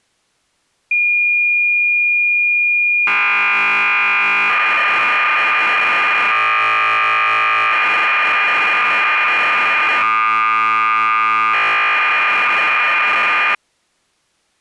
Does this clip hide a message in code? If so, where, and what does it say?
Yes: cassette data (Kansas City type), 1200 baud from 0.9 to 13.6 s, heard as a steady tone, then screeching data.